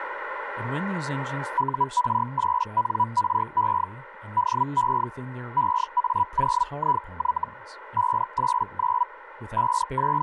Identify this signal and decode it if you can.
Hellschreiber (Feld-Hell, 122.5 baud), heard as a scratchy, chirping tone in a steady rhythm, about 980 Hz, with radio static and speech in English. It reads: UR8NRE DE EA0IY 589 …